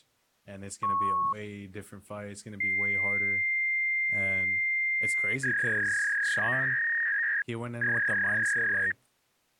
Fax machine handshake, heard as a beep, a long tone and a warble, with speech in English.